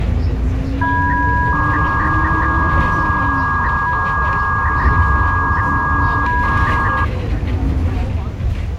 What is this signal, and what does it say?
300-baud modem data (V.21 tones), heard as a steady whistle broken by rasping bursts, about 300 baud, 200 Hz shift, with the noise inside a bus.